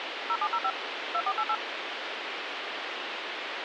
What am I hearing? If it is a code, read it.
DTMF, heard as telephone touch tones, dialled by machine, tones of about 60 ms, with phone line noise. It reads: 0705 2488